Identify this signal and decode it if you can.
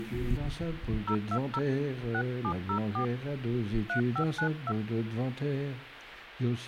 DTMF, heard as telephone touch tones, dialled by hand, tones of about 80 ms, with phone line noise. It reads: 020 6704 3592